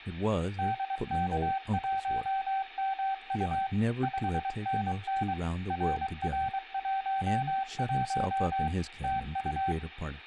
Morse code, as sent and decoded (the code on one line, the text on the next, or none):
-.. -.- .---- -- ..- / ..... -. -. / .-. .-. .---- .---- / - ..-
DK1MU 5NN RR11 TU